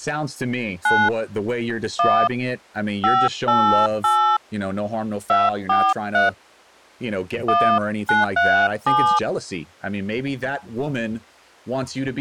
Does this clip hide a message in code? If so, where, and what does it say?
Yes: DTMF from 0.8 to 9.2 s, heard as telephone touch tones, dialled by hand, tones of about 270 ms, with speech in English. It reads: 9 1 588 243 1937